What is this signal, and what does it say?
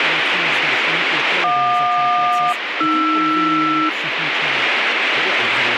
Aircraft SELCAL, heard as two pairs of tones, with radio static and speech in Czech. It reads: JQ-AR